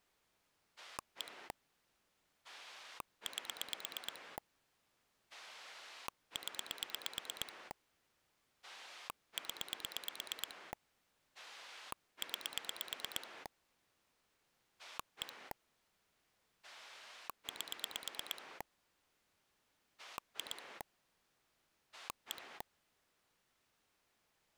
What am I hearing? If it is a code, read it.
Pulse dialling, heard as a rotary dial, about 8 pulses a second. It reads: 1 8 0 0 9 1 8 2 1